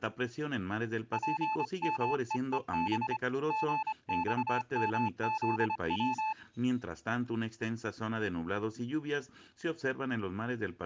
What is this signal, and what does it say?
Morse code, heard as a keyed tone, hand-sent with a paddle, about 25 wpm, 870 Hz. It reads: PMEEB GXMZW